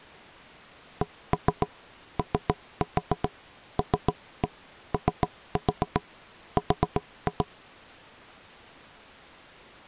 Tap code, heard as knocks on wood, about 7 knocks a second. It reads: COLOR